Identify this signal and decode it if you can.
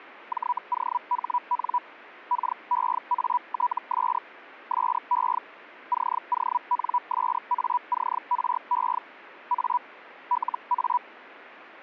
Hellschreiber (Feld-Hell, 122.5 baud), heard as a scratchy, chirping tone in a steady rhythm, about 980 Hz. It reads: JOHN KEATS SE CONSACRE A LA